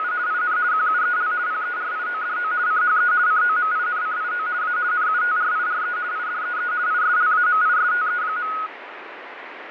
RTTY (50 baud, 170 Hz shift), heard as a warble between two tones, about 1360 Hz centre, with radio static and fading. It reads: … IN QUEL PERIODO CHE COMINCIO A NUTRIRE IDEE ISLAMISTE.